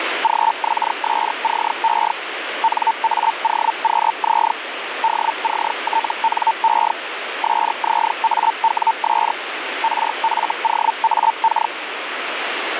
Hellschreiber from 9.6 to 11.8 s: RFOAK

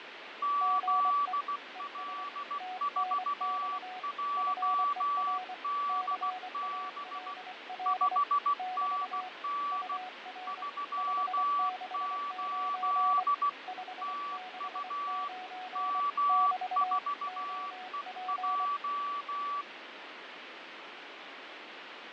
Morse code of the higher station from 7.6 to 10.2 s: 5NN

